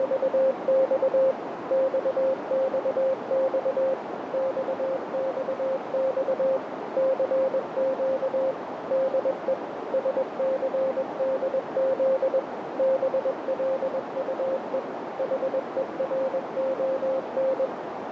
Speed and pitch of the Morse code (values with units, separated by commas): 21 wpm, 530 Hz